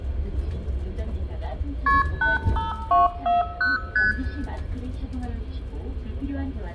Multi-frequency trunk signalling (R1, as on North American trunks), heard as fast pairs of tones, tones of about 160 ms, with room echo and the noise inside a bus. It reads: KP 85240 ST